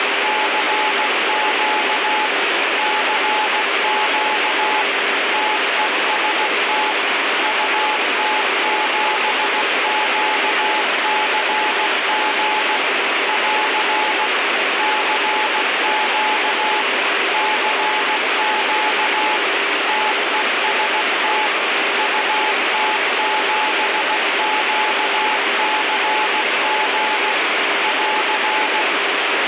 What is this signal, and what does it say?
Morse code, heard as a keyed tone, machine-sent, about 16 wpm, 860 Hz, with heavy radio static. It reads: CQ CQ TEST UT7QCG <AR> CQ CQ TEST UT7QCG <AR>